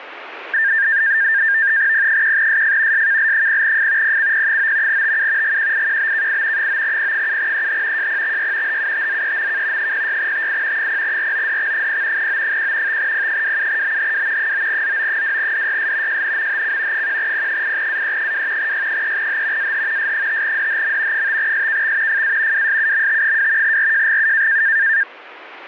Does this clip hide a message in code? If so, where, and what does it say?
Yes: NAVTEX (SITOR-B), 100 baud, 170 Hz shift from 0.5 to 25.0 s, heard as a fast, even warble, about 1700 Hz centre, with radio static. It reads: P1SF SKL0F PCP9 TU GQIQBKI 9P7EH JPXY HUTZEMK 06TI 0RODX0 O1 5P27BHW 9ZO2DYS JNMHC 1P8AE2 Y3H AH S5DHM 5SKX FA WSUMT2 RJGU